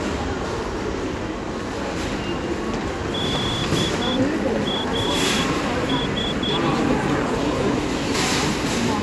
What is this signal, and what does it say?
Morse code, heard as a whistle, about 9 wpm, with the noise of a crowd indoors. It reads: DAS